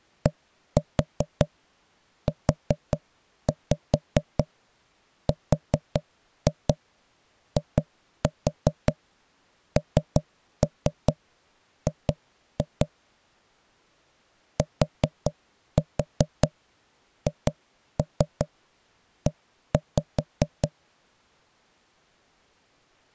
Tap code, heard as knocks on wood, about 5 knocks a second. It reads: DURING THE